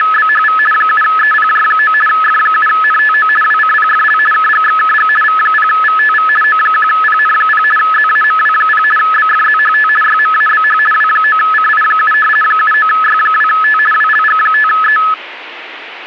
RTTY (50 baud, 450 Hz shift), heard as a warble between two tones, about 1500 Hz centre. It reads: … 7EPJ9 F7NTO WCPFL KGXKG V0VTV O1PN0 ZAMW0 BFZHT YMABH W9CI7 79Y2T WLG5E